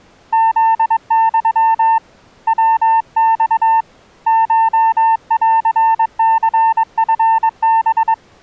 Morse code (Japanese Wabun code), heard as a keyed tone, hand-sent with a paddle, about 22 wpm, 900 Hz. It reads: フユ ヤマ コンニチハ